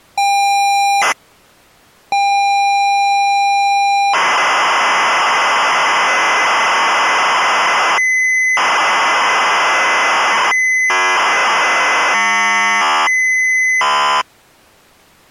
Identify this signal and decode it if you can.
ZX Spectrum tape loading, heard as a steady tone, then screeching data.